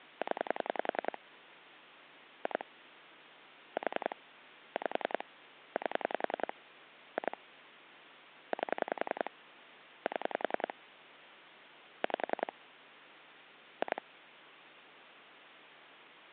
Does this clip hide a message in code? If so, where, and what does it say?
Yes: pulse dialling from 0.2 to 14.0 s, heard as clicks on a phone line, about 10 pulses a second, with phone line noise. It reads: 0 2 4 5 8 2 8 7 5 2